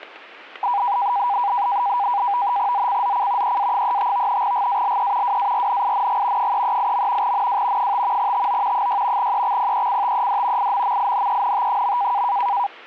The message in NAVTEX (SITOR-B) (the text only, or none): ZCZC EA35 GALE WARNING 338. NW 5 TO 6 EXPECTED IMMINENT.